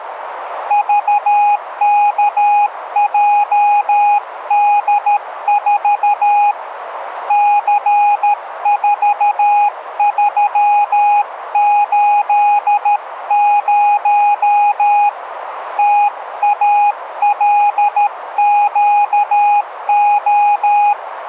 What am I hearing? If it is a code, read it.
Morse code, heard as a keyed tone, hand-sent with a paddle, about 13 wpm, 820 Hz, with radio static. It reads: VKJD4 C4380 TALQO